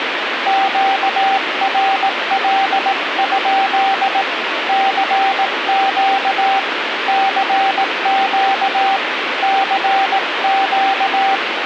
Morse code, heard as a keyed tone, hand-sent with a paddle, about 18 wpm, 780 Hz, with radio static. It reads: QRL? CQ CQ CQ